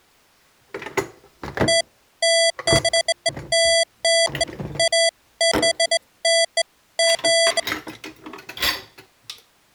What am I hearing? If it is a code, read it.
Beeps of irregular length, with kitchen noise. There is no code.